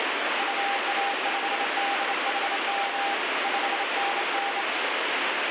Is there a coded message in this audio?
Yes: Morse code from 0.3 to 4.7 s, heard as a keyed tone, hand-sent with a straight key, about 27 wpm, 800 Hz, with heavy radio static. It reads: UA5DHM 5NN